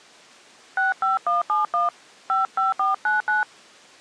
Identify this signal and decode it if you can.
DTMF, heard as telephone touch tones, dialled by hand, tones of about 150 ms. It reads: 65171 55499